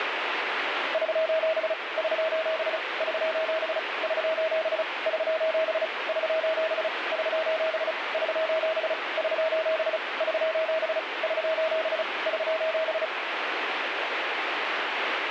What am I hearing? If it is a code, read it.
Morse code, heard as a keyed tone, machine-sent, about 35 wpm, 640 Hz, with radio static. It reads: <SOS> <SOS> <SOS> <SOS> <SOS> <SOS> <SOS> <SOS> <SOS> <SOS> <SOS> <SOS>